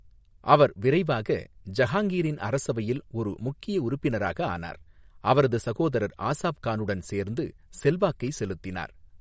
Speech in Tamil. There is no code.